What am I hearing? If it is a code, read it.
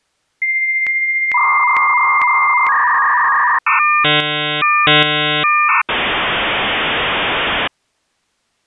Dial-up modem handshake (V.34 or later), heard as a whistle, warbles, then hiss.